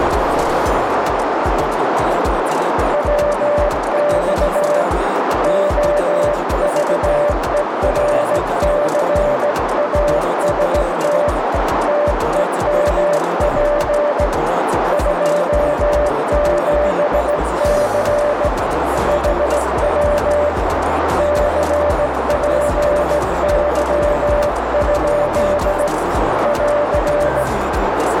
Morse code, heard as a keyed tone, hand-sent with a straight key, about 17 wpm, 590 Hz, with heavy radio static and a narrow filter. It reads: WX OVERCAST TEMP 27C HW CPY? <AR>